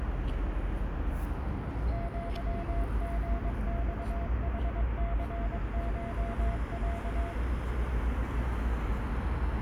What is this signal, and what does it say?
Morse code (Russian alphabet), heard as a keyed tone, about 22 wpm, 680 Hz, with radio static, a narrow filter and the noise of a residential street. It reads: ЪГЬХЦШЯ